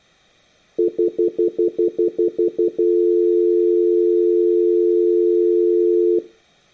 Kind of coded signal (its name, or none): telephone call progress tone